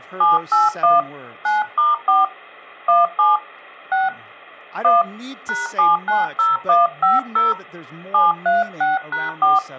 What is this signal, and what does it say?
DTMF, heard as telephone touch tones, dialled by hand, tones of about 170 ms, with speech in English. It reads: 781 9*4 17 6 1 #790150 736#4